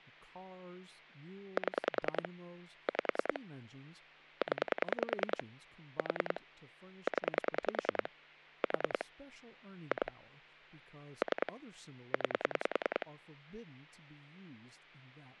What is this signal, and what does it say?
Pulse dialling, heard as clicks on a phone line, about 10 pulses a second, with hum and speech in English. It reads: 7 5 0 4 0 4 2 3 9